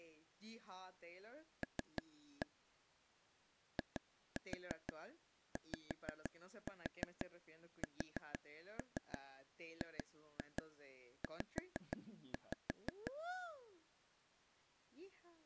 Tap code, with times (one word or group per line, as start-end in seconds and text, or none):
1.6-2.5 L
3.8-13.1 IYSGZ